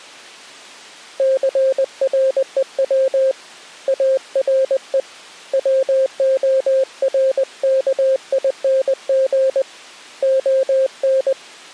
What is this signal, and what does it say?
Morse code, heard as a keyed tone, hand-sent with a paddle, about 20 wpm, 530 Hz. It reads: CREW ARE WORKING ON